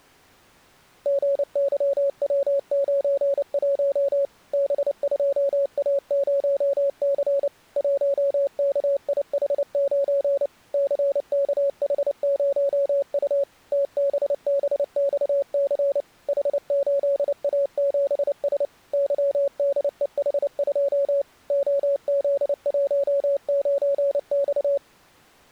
Morse code, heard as a keyed tone, machine-sent, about 29 wpm, 560 Hz. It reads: GYW91 B2A0C 1KIH9 CKH0U TBBXC H8A7S YDEH2 OZ19X